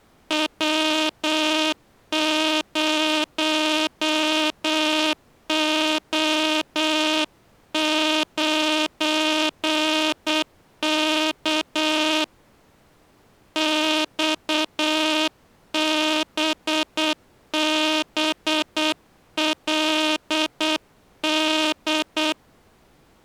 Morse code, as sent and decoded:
.-- ----- --- ----. -.- / -..- -... -... .-.. -..
W0O9K XBBLD

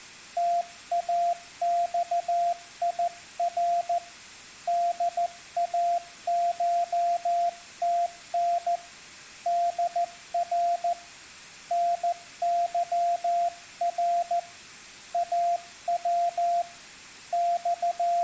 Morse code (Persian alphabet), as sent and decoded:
- .- -..- .. .-. / -.. .- ---- - -. / -.. .-. / -. -.-- .-. / .- .-- / …
تاخیر داشتن در نظر او …

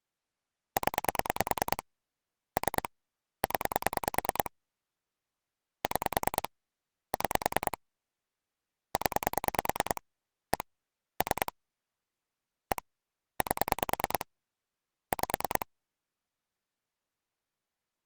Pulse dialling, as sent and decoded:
10 / 3 / 10 / 6 / 6 / 10 / 1 / 3 / 1 / 8 / 5
0 3 0 6 6 0 1 3 1 8 5

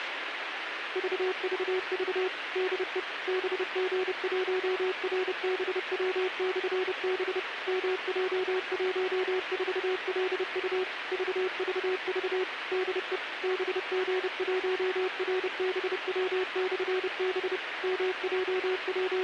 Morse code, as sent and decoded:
...- ...- ...- / -.. . / -... --. .---- .-. -... .-- -..-. -... / -- .--- .---- ....- .-.. ..- / ...- ...- ...- / -.. . / -... --. .---- .-. -... .-- -..-. -... / …
VVV DE BG1RBW/B MJ14LU VVV DE BG1RBW/B …

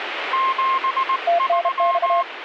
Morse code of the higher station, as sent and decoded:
--... ...--
73

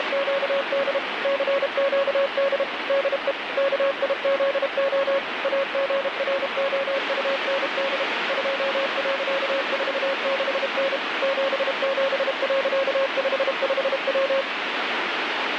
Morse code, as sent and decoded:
… / -.-. --.- -.. / -.. . / -.- .. --.. --- / .- --. .-. --- ..- -. -.. / ..--- .-.-.- ....- -.... -. / --... --... .-.-.- ..... ..... .--
… CQD DE KIZO AGROUND 2.46N 77.55W

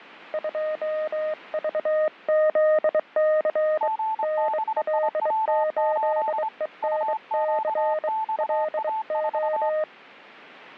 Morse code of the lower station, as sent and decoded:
..--- ...- --.. -.-. / -. .-.. ---.. . -. -.-. / .-.. ---
2VZC NL8ENC LO

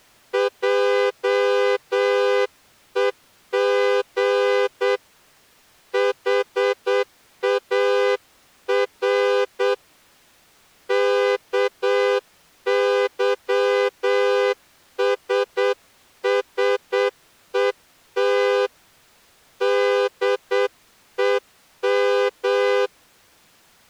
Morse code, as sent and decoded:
.--- . --. / .... .- .-. / -.- -.-- ... ... . - / -.. . --
JEG HAR KYSSET DEM

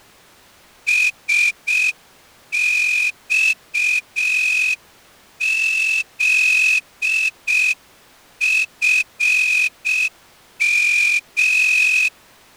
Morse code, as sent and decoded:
... -..- --.. ..-. --
SXZFM

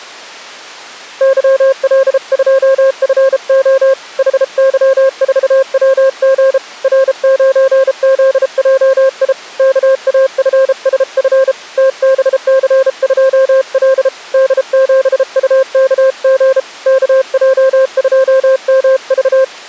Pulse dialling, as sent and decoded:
none

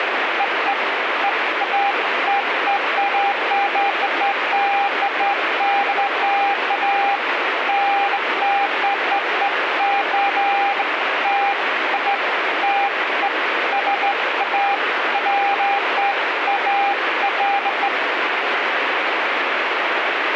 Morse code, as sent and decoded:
none

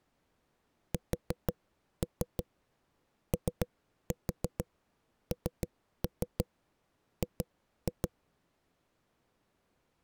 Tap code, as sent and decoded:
4-3 3-4 3-3 2-2
SONG

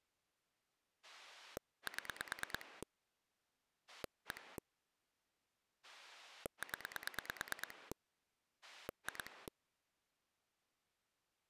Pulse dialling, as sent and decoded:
7 / 1 / 10 / 2
7 1 0 2

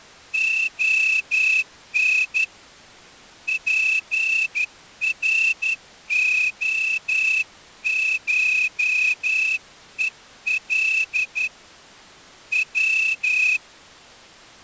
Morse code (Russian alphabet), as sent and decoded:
--- -. / .--. .-. --- ---- . .-.. / .--
ОН ПРОШЕЛ В

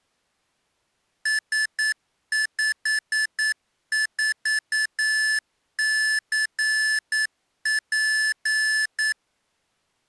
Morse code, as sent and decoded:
... ..... ....- -.-. .--.
S54CP

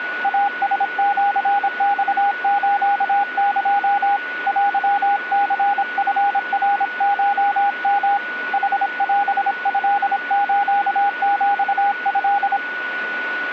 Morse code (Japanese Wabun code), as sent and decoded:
.- ... --.-. -..- ---.- -.--- / .-.-- -.-. ..-. .-. ---- -- / .... .-... ..-.. ---.- --..- ..-..
イラシマスエ テニチナコヨ ヌオトスヒト

